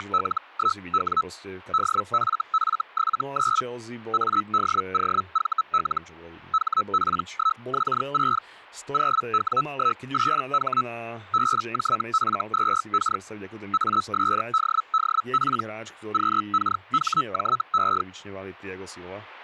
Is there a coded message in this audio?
Yes: Hellschreiber (Feld-Hell, 122.5 baud) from 0.0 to 18.0 s, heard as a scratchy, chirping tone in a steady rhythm, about 1300 Hz, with speech in Slovak. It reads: … DFF79 ADOVL HP1X6 0W18H BJF2K ASDDP QKHJE